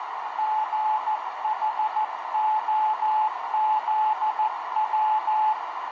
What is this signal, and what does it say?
Morse code, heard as a keyed tone, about 14 wpm, 860 Hz, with heavy radio static and a narrow filter. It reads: GHOZW